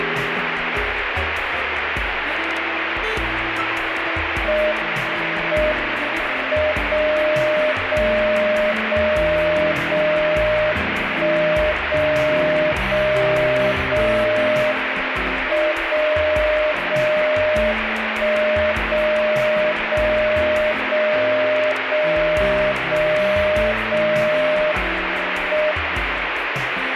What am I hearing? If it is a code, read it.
Radio time signal (WWVB), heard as a tone whose level steps once a second, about 610 Hz, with radio static. The time is 20:08 UTC. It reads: M M 0 0 0 0 1 0 0 0 M 0 0 1 0 0 0 0 0 0 M